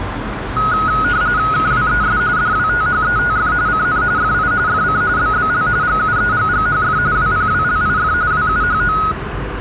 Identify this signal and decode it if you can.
RTTY (45.45 baud, 170 Hz shift), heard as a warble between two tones, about 1360 Hz centre, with radio static, a narrow filter and street noise. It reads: KWES DWTHETF CN FI FC BBL GUEGGHF WPWLIF WUHO